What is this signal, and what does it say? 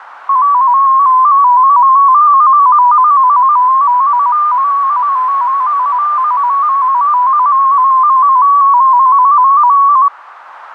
Multi-tone FSK (Olivia or MFSK type), about 250 Hz wide, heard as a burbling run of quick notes, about 15.625 baud, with radio static and a narrow filter.